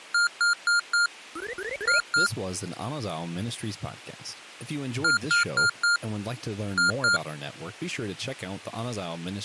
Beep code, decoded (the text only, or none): 4-2